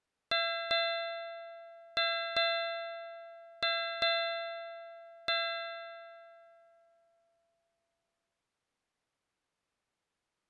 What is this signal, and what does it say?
Ship's bell, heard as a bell. 7. Seven half-hours of the watch have passed.